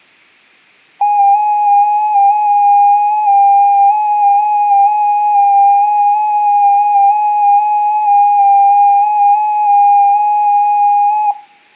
FT8 (one signal), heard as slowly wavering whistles, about 6.25 baud, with room echo.